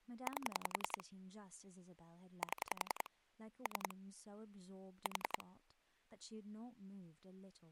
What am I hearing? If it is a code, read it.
Pulse dialling, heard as clicks on a phone line, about 10 pulses a second, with speech in English. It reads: 8 7 3 4